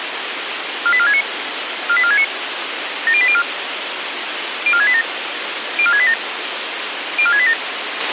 Five-tone selective call (ZVEI), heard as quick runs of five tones, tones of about 70 ms, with radio hiss and a squelch burst at the end. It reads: 48469 48469 70804 04687 04687 04687